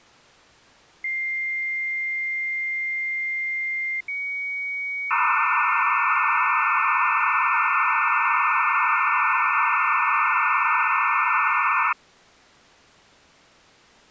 Dial-up modem handshake (low-speed, two carriers), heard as two whistles, then hiss.